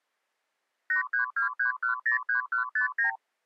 Multi-frequency trunk signalling (R2, with the far end's replies), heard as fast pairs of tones, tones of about 120 ms. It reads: 8323103159